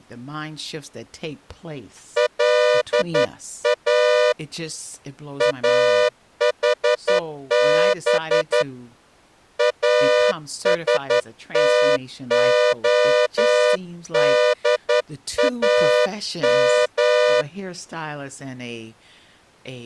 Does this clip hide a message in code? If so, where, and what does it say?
Yes: Morse code (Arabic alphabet) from 2.1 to 17.5 s, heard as a horn, hand-sent with a straight key, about 11 wpm, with speech in English. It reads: لا احب استخدام